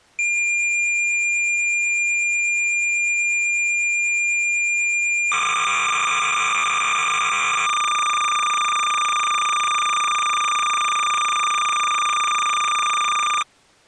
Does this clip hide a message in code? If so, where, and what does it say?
Yes: cassette data (Kansas City type), 300 baud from 0.2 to 13.4 s, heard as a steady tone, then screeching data.